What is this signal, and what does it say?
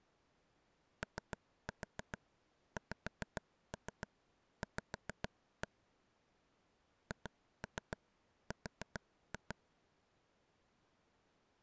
Tap code, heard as taps on a table, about 7 knocks a second. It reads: OXV HR